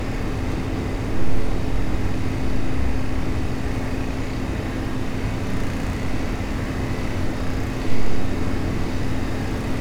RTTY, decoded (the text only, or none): none